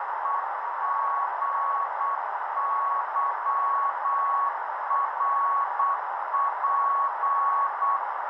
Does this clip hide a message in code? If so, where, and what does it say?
Yes: Morse code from 0.2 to 8.0 s, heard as a keyed tone, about 8 wpm, 1110 Hz, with heavy radio static and a narrow filter. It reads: EGYRP